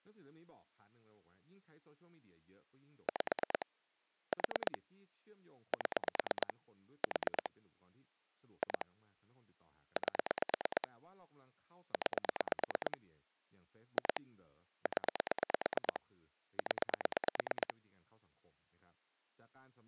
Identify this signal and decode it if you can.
Pulse dialling, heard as clicks on a phone line, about 9 pulses a second, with speech in Thai. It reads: 5 4 7 4 2 8 9 2 0 0